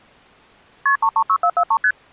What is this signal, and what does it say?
Multi-frequency trunk signalling (R1, as on North American trunks), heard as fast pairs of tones, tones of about 70 ms. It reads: KP 336443 ST